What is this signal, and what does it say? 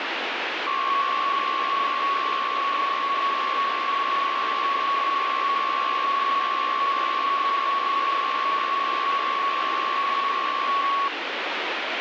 PSK63 (62.5 baud), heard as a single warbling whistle, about 1110 Hz, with radio static.